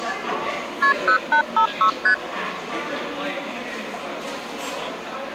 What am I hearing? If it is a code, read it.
Multi-frequency trunk signalling (R1, as on North American trunks), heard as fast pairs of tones, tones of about 90 ms, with the noise of a cafe. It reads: KP 0856 ST